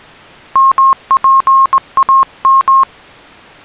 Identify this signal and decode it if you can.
Morse code (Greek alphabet), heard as a keyed tone, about 19 wpm, 1070 Hz. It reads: ΜΠΑΜ